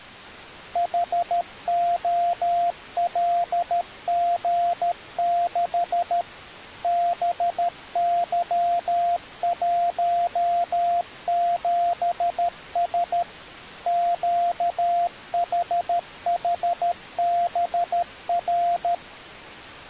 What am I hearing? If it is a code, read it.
Morse code, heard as a keyed tone, machine-sent, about 13 wpm, 700 Hz. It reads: HOLG6 BY17S QHHBR